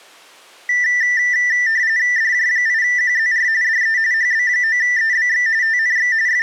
RTTY (45.45 baud, 170 Hz shift), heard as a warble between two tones, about 1900 Hz centre. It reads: DJ8QZR DE HB9EBX TNX …